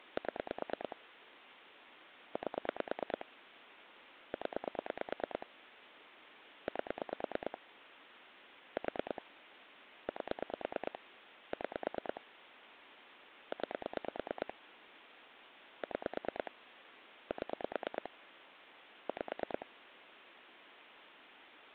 Pulse dialling, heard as clicks on a phone line, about 9 pulses a second, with phone line noise. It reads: 7 8 0 8 4 8 6 9 6 7 5